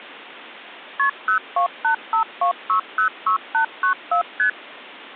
Multi-frequency trunk signalling (R1, as on North American trunks), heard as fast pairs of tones, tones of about 100 ms. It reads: KP 02852606894 ST